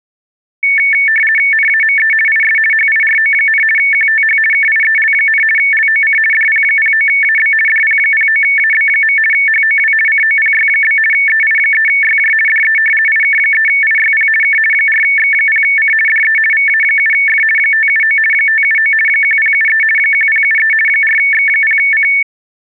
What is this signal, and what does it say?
RTTY (50 baud, 450 Hz shift), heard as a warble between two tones, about 2000 Hz centre. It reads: NAME IS HIRO, QTH KIEL, LOC DP09AB DP09AB. HOW COPY? EI3YJ DE IK3IYP K 4X0C DE VA7F 579 579 1073 1073 4X0C